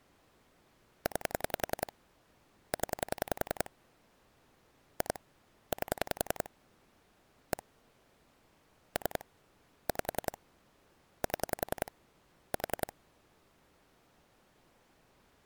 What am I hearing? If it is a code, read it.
Pulse dialling, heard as clicks on a phone line, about 10 pulses a second. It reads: 9 0 2 8 1 3 5 7 4